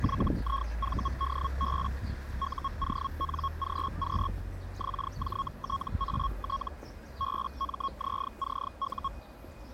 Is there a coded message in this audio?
Yes: Hellschreiber (Feld-Hell, 122.5 baud) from 0.0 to 9.1 s, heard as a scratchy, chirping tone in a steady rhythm, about 1090 Hz, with the noise of a residential street. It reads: YIVDB UONGQ XJTAT BMZCU